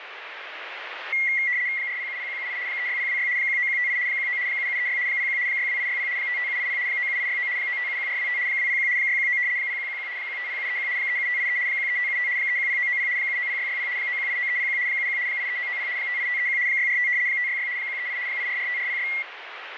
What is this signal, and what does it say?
RTTY (75 baud, 170 Hz shift), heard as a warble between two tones, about 2050 Hz centre, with radio static. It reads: 4070178 36026 19158 19 7736 01 62860 55780 97869 9571425 201 619 0111 150731 37583 13575 310990 790660 9189301 71 83990 58531 645 566 138 8445406